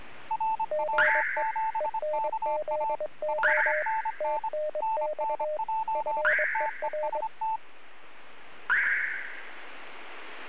Morse code, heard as two keyed tones. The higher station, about 25 wpm, 880 Hz: RW7KA 5NN NNJ TEST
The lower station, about 22 wpm, 610 Hz: GE ENZO TNX FER